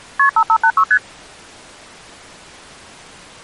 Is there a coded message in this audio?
Yes: multi-frequency trunk signalling (R1, as on North American trunks) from 0.2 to 1.0 s, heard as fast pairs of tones, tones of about 70 ms. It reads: KP 5586 ST